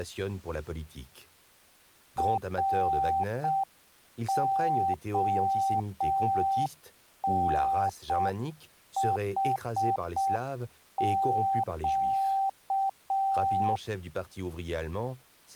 Morse code, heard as a keyed tone, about 6 wpm, 780 Hz, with speech in French. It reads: RONHQ